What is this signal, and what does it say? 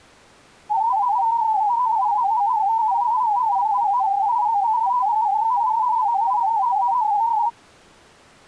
Multi-tone FSK (Olivia or MFSK type), about 250 Hz wide, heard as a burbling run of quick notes, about 31.25 baud.